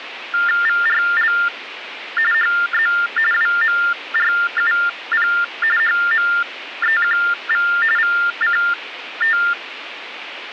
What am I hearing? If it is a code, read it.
TTY/TDD text telephone tones (45.45 baud Baudot), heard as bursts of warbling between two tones, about 400 Hz shift, 1600 Hz centre, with phone line noise. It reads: VRL HZ WMRUP HMEQV VCT